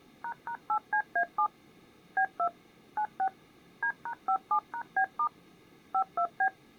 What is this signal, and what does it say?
DTMF, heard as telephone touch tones, dialled by machine, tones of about 80 ms. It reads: ##8CA7 B2 96 D#57#B* 52B